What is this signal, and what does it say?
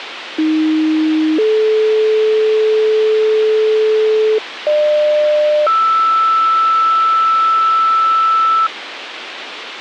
Two-tone page, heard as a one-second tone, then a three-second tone, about 310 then 430 Hz, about 600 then 1320 Hz, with radio hiss.